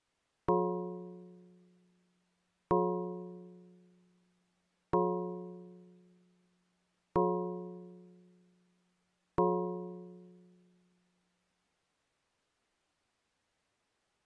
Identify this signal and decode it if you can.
Clock strike, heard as a bell. 5. Five o'clock.